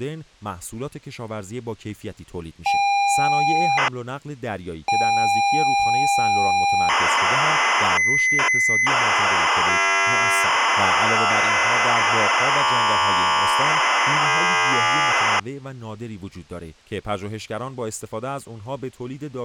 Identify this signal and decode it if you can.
ZX Spectrum tape loading, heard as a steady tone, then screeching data, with speech in Persian.